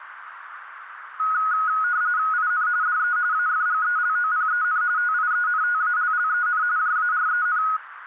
RTTY (45.45 baud, 170 Hz shift), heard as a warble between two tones, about 1360 Hz centre, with radio static and a narrow filter. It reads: IN DE AFGELOPEN TIENTALLEN JAREN